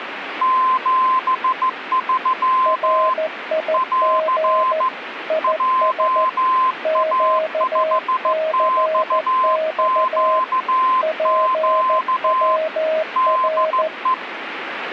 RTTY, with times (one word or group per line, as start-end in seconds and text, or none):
none